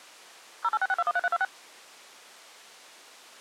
DTMF, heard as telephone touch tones, dialled by machine, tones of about 40 ms. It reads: 0866213326